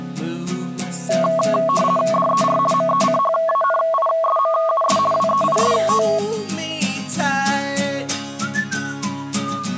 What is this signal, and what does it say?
RTTY (50 baud, 450 Hz shift), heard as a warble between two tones, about 880 Hz centre. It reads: DER MECHANISMUS WEIST